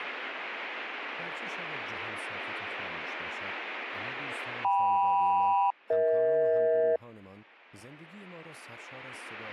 Aircraft SELCAL, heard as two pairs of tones, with speech in Persian. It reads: KM-EH